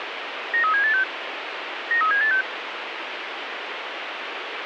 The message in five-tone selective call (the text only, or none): 93786 93786